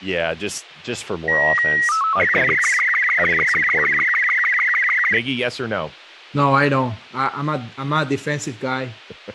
SSTV (slow-scan television), Robot 36, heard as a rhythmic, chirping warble, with speech in English.